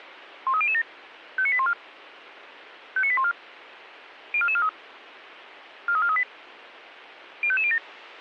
Five-tone selective call (ZVEI), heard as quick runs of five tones, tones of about 70 ms, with radio hiss. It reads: 13007 59814 59814 04443 43438 05507